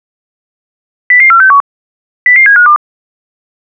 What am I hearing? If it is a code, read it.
Five-tone selective call (CCIR), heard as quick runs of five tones, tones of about 100 ms. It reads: 00461 00752